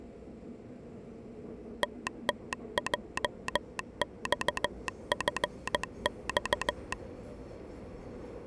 Morse code, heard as a telegraph sounder, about 15 wpm, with the noise inside a subway train. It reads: TTJXFX